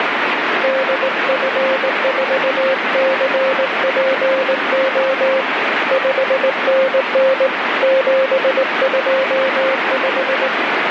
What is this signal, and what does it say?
Morse code, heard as a keyed tone, hand-sent with a straight key, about 19 wpm, 530 Hz, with heavy radio static. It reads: DF4CPO 5NN 725